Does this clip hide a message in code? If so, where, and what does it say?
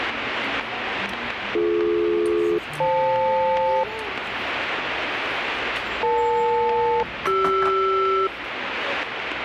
Yes: aircraft SELCAL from 1.5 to 8.3 s, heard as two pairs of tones, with radio static and the noise of a restaurant. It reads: BD-FL EL-CR